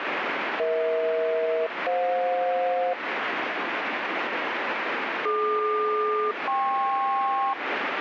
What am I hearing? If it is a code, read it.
Aircraft SELCAL, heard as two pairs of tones, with radio static. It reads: EH-FJ DQ-KP